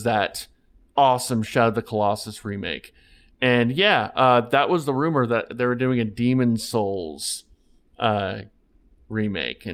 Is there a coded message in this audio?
No, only speech in English.